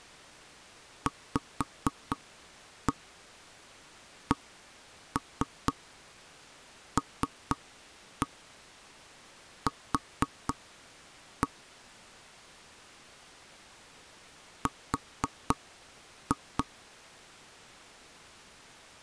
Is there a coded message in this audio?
Yes: tap code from 1.1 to 16.7 s, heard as knocks on wood, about 4 knocks a second. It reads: VCLQ R